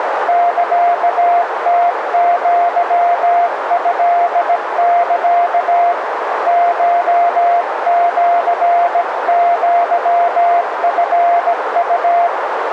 Morse code (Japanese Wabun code), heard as a keyed tone, hand-sent with a bug key, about 17 wpm, 700 Hz, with radio static and a narrow filter. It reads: サムアトサ コシアチウ